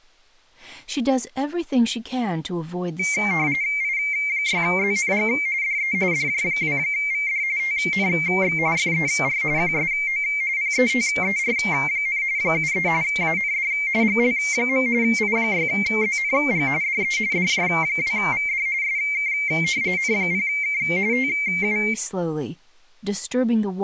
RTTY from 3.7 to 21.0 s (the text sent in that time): I6ZNG DE DJ2VD TNX FER QSO PETER, 73 AND GL. I6ZNG DE DJ2VD SK N0K